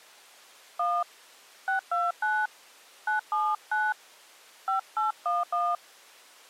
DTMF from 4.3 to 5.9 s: 5811

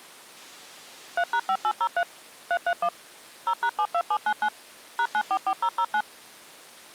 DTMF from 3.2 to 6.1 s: 0#72799 #944009

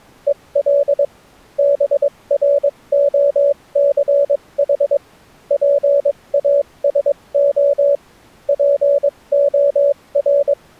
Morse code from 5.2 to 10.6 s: PASO POR

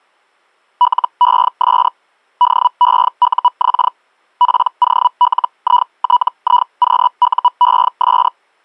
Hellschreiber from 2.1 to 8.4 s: DEUX POLITIQUES

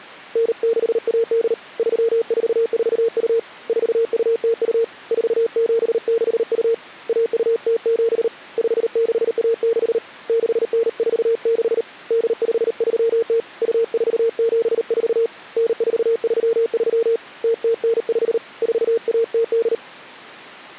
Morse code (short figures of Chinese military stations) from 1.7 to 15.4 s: 3442 4202 4762 1207 5616 6946 8530 2474

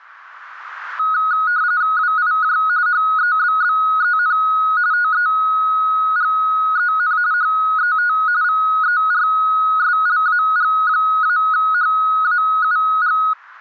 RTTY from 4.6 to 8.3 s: TEGEN HET

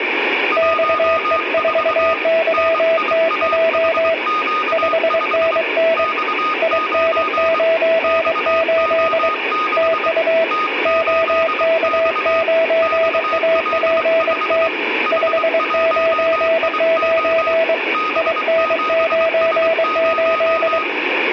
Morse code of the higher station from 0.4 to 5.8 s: 14 NIAHQ5

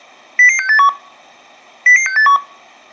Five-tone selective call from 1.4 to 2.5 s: 00681

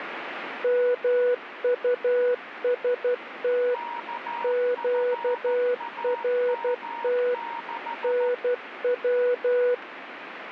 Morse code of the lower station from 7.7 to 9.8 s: NW

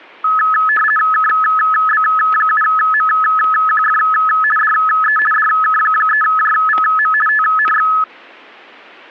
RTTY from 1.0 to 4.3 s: KB7MQF

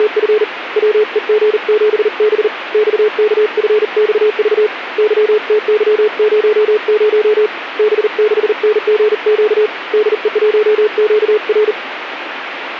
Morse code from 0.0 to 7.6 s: … WEG7B XKFXV YTY00

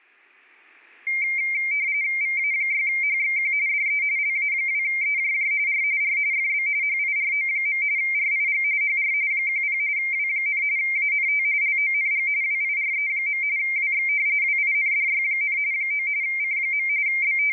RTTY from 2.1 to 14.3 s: VA6HXQ DE LA2EJJ R R FB HIRO. RIG HR 10 W, ANT LONG WIRE. WX

